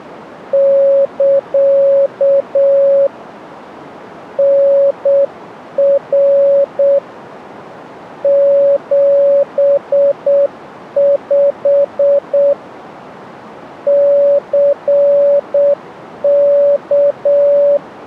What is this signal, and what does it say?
Morse code, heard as a keyed tone, hand-sent with a paddle, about 7 wpm, 560 Hz. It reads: <KA> NR 75 CK